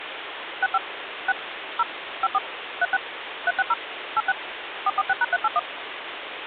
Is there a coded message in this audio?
Yes: DTMF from 0.6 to 5.6 s, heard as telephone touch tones, dialled by machine, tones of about 40 ms, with phone line noise. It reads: 65 6 0 54 36 360 86 446#381